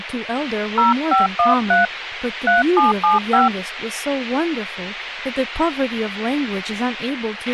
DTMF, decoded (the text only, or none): 0513 3775